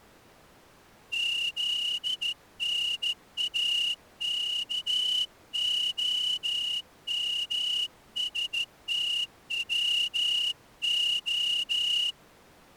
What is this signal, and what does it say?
Morse code (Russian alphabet), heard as a whistle, hand-sent with a straight key, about 14 wpm. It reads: ЗНАКОМСТВО